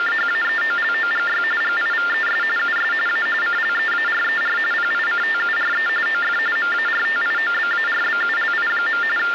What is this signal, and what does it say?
TTY/TDD text telephone tones (45.45 baud Baudot), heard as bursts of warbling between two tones, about 400 Hz shift, 1600 Hz centre, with phone line noise. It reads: … GIVES US A CLEARER PICTURE OF MARTIOBARBULI. …